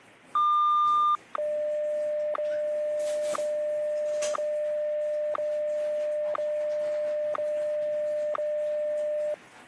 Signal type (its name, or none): radio time signal